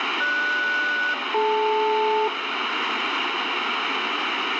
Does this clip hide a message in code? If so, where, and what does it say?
Yes: aircraft SELCAL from 0.2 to 2.3 s, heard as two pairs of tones, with radio static and room echo. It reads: GS-DL